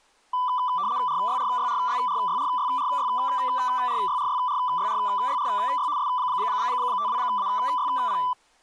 RTTY (75 baud, 170 Hz shift), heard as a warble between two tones, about 1080 Hz centre, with speech in Maithili. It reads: RYRYRYRYRYRYRYRYRYRYRY S52AYP